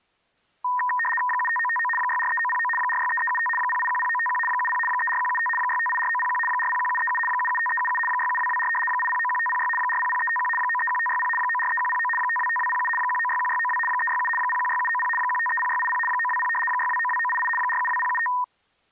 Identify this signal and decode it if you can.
RTTY (75 baud, 850 Hz shift), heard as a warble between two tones, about 1420 Hz centre. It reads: 75959 643909 463375 0810951 70 34175 6584901 401737 775377 67224 8091506 400351 931560 943109 525207 1961692 367 016790 1530680 920 6292988 472075